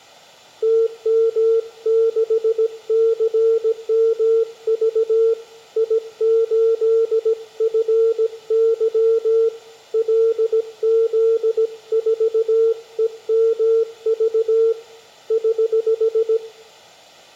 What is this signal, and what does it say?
Morse code, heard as a keyed tone, hand-sent with a paddle, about 17 wpm, 450 Hz, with room echo. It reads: TM6CMV I8FY LZ4EMV <HH>